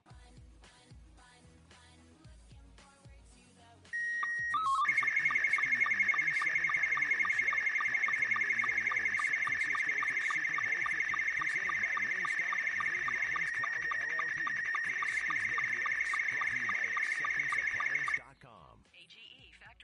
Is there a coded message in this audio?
Yes: SSTV (slow-scan television), Scottie S2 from 3.9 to 18.2 s, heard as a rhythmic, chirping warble.